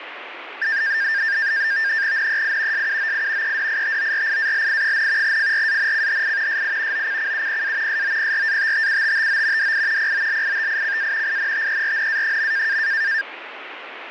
NAVTEX (SITOR-B), 100 baud, 170 Hz shift, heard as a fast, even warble, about 1700 Hz centre, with radio static. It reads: NEI SUOI EDITORIALI, FRANCHI SI OCCUPA SOPRATTUTTO DI POLITICA INTERNA.